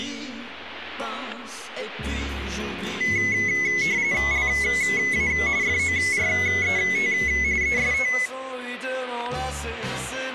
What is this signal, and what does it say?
RTTY (45.45 baud, 170 Hz shift), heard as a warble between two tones, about 2100 Hz centre, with static crashes. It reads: LA FORET EST